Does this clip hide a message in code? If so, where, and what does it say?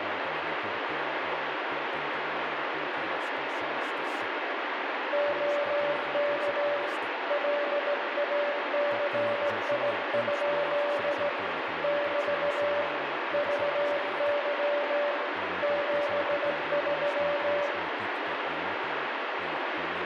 Yes: Morse code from 5.1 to 17.7 s, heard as a keyed tone, hand-sent with a straight key, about 17 wpm, 580 Hz, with radio static and room echo. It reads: OK LACI? <BT> VY 73